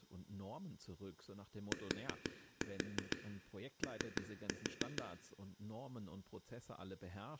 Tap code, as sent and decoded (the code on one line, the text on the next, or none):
4-4 3-4
TO